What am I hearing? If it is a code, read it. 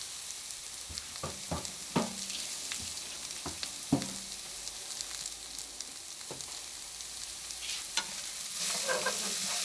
Kitchen noise. There is no code.